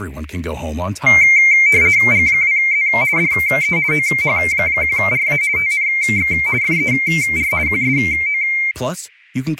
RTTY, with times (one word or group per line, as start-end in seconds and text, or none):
2.1-2.9 G2Z
3.2-3.8 DE
3.9-5.4 OH1RA
5.6-6.3 TNX
6.6-7.5 FER
7.7-8.4 QSO